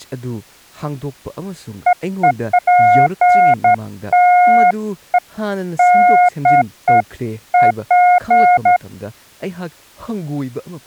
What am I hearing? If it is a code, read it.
Beeps of irregular length, with speech in Manipuri. There is no code.